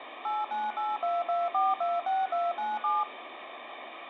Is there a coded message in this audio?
Yes: DTMF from 0.2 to 3.0 s, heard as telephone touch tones, dialled by machine, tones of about 200 ms, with phone line noise. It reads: 89822426297